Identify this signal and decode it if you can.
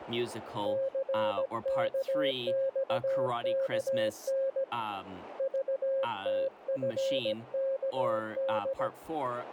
Morse code, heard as a keyed tone, hand-sent with a paddle, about 17 wpm, 540 Hz, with radio static and speech in English. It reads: CKXKN VTFKD